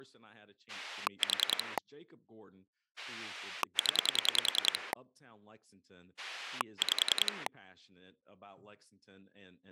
Pulse dialling, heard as a rotary dial, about 10 pulses a second, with speech in English. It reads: 4 0 5